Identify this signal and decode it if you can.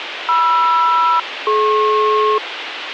Aircraft SELCAL, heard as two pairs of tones, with radio hiss. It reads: MR-DP